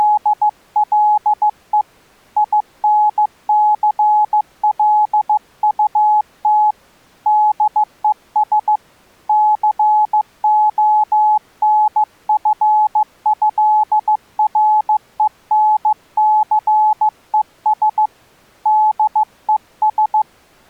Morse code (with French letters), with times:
0.0-1.8 …
2.4-6.7 INCLUT
7.3-8.8 DES
9.3-18.1 CONFÉRENCES
18.7-20.2 DES

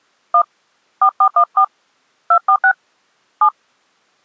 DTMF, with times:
0.3-0.4 1
1.0-1.6 4414
2.3-2.7 246
3.4-3.5 7

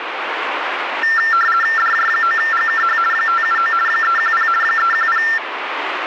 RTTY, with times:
1.8-3.0 DJ9GKH
3.1-3.7 579
3.9-4.5 310
4.6-5.2 310

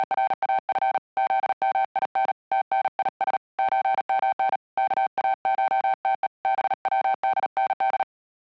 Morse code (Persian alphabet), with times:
0.0-1.0 …
1.2-2.3 زمین
2.5-3.4 تنیس
3.6-4.6 چمن
4.8-6.3 کاشته
6.4-8.0 بودند

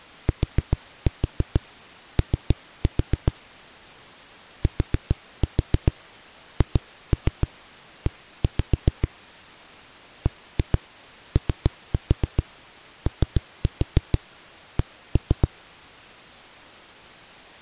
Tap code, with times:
0.3-3.3 TO
4.6-9.1 THE
10.3-15.5 BOOK

